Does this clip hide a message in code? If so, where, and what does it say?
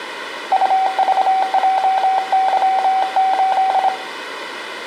Yes: Morse code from 0.5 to 3.9 s, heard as a keyed tone, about 26 wpm, 760 Hz, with room echo. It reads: UVJY8